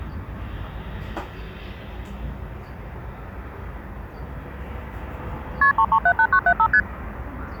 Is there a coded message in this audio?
Yes: multi-frequency trunk signalling (R1, as on North American trunks) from 5.6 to 6.8 s, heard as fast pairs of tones, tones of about 70 ms, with the noise of a residential street. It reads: KP 3378975 ST